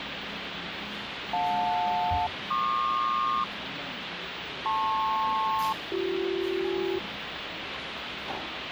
Aircraft SELCAL, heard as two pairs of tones, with radio hiss and the noise of a cafe. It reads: JL-PQ LP-BC